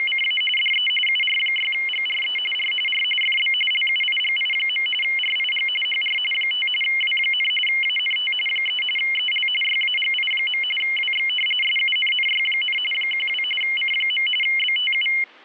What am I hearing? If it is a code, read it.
RTTY (45.45 baud, 850 Hz shift), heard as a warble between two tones, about 2550 Hz centre. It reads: … DE UR6GRE R R FB LUIGI. RIG HR 5 W, ANT 3 EL YAGI. WX SUNNY, 12 C. BTU